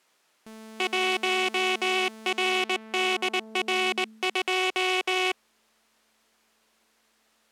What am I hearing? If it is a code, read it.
Morse code, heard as a buzzer, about 19 wpm. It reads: 1RDR2